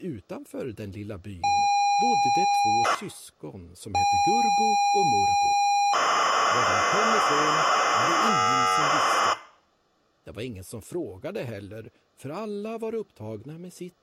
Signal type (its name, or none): ZX Spectrum tape loading